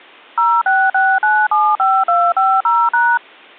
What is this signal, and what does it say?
DTMF, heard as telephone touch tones, dialled by machine, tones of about 240 ms. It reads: 066975250#